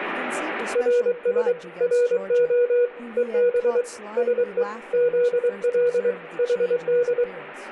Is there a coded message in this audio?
Yes: Morse code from 0.7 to 7.3 s, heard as a keyed tone, hand-sent with a paddle, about 23 wpm, 480 Hz, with room echo and speech in English. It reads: RS RO EB SE ZL HD